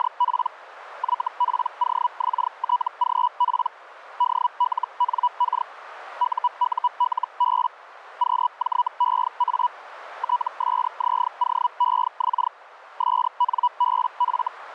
Hellschreiber (Feld-Hell, 122.5 baud), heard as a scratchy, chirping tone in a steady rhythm, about 980 Hz, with radio static. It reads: … YPOXTGP DLNK UULB QJEA TSZOEX SNBF